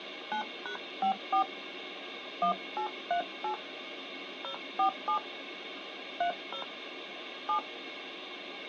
DTMF, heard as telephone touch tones, dialled by hand, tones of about 100 ms, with phone line noise. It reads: 9#54 1838 047 30 7